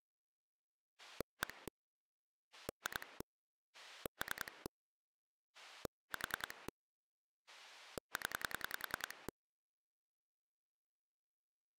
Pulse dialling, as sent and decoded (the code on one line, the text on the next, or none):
1 / 2 / 3 / 4 / 10
1 2 3 4 0